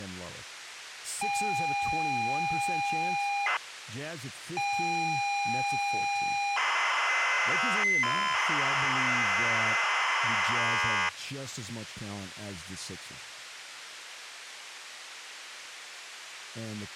ZX Spectrum tape loading, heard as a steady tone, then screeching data, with speech in English.